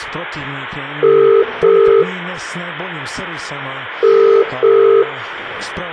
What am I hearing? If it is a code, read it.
Telephone call progress tone (as in the UK, Ireland, Australia and similar networks), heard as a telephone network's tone, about 400, 450 Hz, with room echo. Ringback tone.